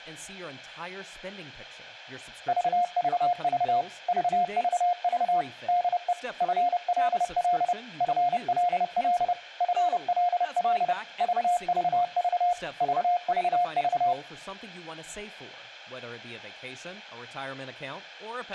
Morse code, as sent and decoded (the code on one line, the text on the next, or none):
...- ...- ...- / ...- ...- ...- / -.. . / ..-. .-.. .-.. / ..-. .-.. .-.. / ..-. .-.. .-.. / ...- ...- ...- / ...- ...- ...-
VVV VVV DE FLL FLL FLL VVV VVV